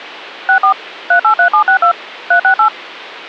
DTMF, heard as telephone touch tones, dialled by machine, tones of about 100 ms. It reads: 64 383762 368